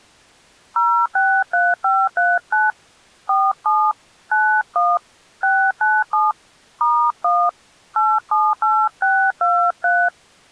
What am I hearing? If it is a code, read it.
DTMF, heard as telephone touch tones, dialled by hand, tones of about 240 ms. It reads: 063539 47 91 697 *1 878623